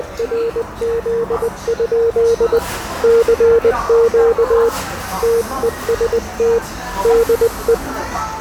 Morse code, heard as a keyed tone, hand-sent with a paddle, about 20 wpm, 460 Hz, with radio static, fading and the noise of a cafe. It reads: … CQ TEST DE